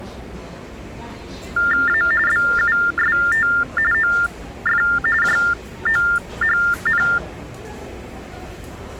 TTY/TDD text telephone tones (45.45 baud Baudot), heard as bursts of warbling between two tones, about 400 Hz shift, 1600 Hz centre, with the noise of a crowd indoors. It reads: A BUST OF JOHN